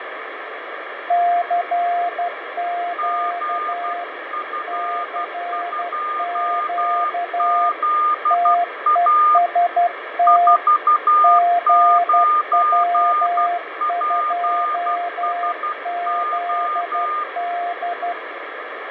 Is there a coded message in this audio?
Yes: Morse code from 1.0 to 18.2 s, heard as two keyed tones, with heavy radio static and fading. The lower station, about 12 wpm, 700 Hz: CQ CQ TEST GW2ZD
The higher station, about 12 wpm, 1210 Hz: GF2ZA 49PSO